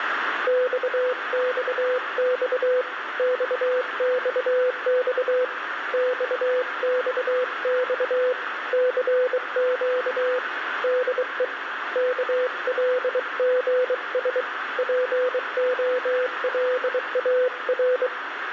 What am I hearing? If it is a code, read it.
Morse code, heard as a keyed tone, hand-sent with a bug key, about 23 wpm, 500 Hz, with radio static and room echo. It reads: XXX XXX XXX CQ DE KLGS POLAR